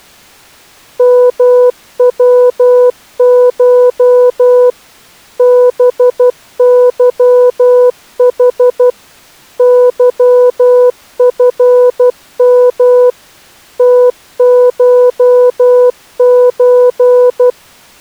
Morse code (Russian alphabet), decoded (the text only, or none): МВШ БЫХ ЫФМ ТШЧ